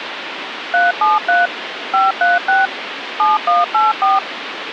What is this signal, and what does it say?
DTMF, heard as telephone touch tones, dialled by machine, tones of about 170 ms, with phone line noise. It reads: 373 536 7184